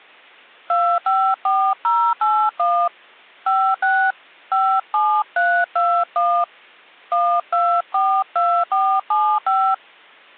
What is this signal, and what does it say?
DTMF, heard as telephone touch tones, dialled by hand, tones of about 280 ms. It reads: 254081 56 57321 1242475